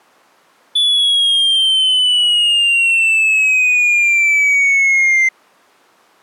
A tone that sweeps in pitch again and again. There is no code.